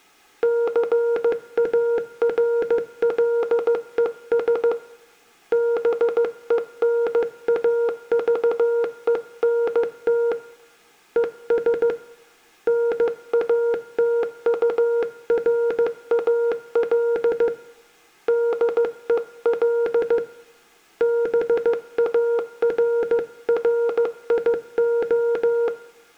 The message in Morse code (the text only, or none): CARLES BENAVENT ES NATURAL DEL BARRIO